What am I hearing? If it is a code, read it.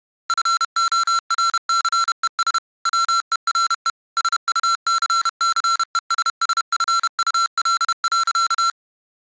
Morse code, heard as electronic beeps, machine-sent, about 31 wpm, 1360 Hz. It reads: FORCES WERE SUCCESSFUL.